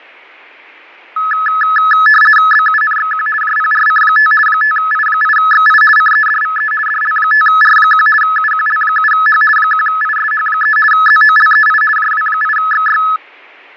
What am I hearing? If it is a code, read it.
RTTY (50 baud, 450 Hz shift), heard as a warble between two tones, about 1500 Hz centre, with fading. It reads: BUNXQ JPRC5 5I8XI CEDVE DL5R1 UQL7H 1ISH3 ZOLEI JW8XY